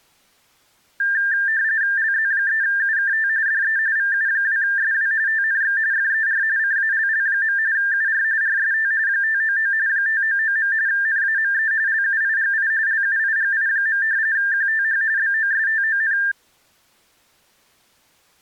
RTTY (45.45 baud, 170 Hz shift), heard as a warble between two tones, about 1700 Hz centre. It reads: LZ3UKT DE VU2SW TNX FER CALL. UR RST 599 599. NAME LUIGI LUIGI. QTH BOSTON